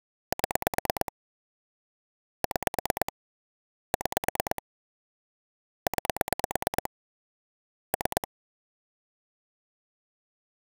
Pulse dialling, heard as clicks on a phone line, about 9 pulses a second. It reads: 7 6 6 9 3